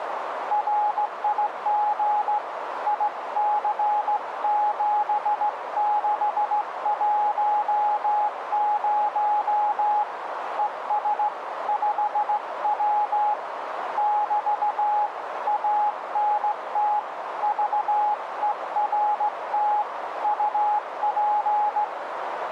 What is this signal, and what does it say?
Morse code, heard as a keyed tone, hand-sent with a straight key, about 16 wpm, 840 Hz, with radio static and a narrow filter. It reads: RIG IC7610 ES 5W <BT> ANT VERT UP